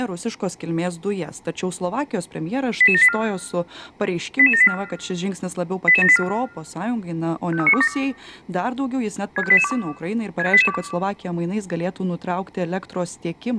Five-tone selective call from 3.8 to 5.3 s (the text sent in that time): 88784